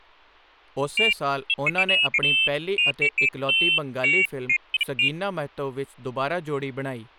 Pairs of high tones at irregular times, with speech in Punjabi. There is no code.